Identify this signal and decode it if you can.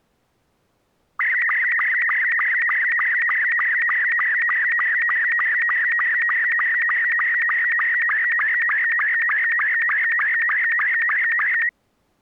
SSTV (slow-scan television), Robot 72, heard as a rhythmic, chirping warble.